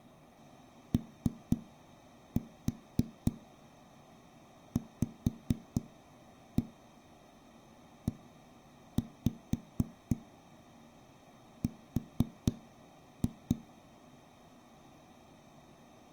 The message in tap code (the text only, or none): OVER